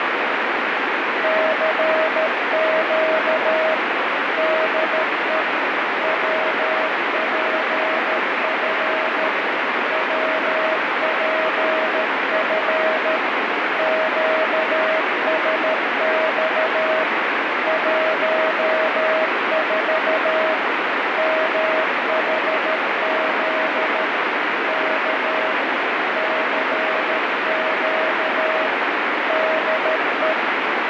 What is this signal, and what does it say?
Morse code, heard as a keyed tone, machine-sent, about 13 wpm, 640 Hz, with heavy radio static. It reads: CQ DE WPF WPF QSX 14 MHZ K CQ DE